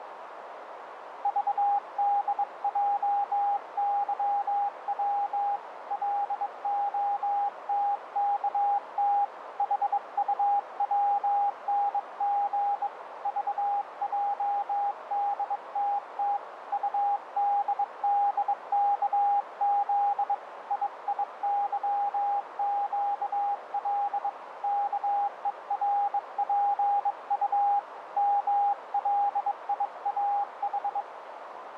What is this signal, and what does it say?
Morse code, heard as a keyed tone, hand-sent with a bug key, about 22 wpm, 810 Hz, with radio static and a narrow filter. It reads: VDJYW LOTKT HUWNG VJDTT UDDKZ IIYQL KERPU MLIAH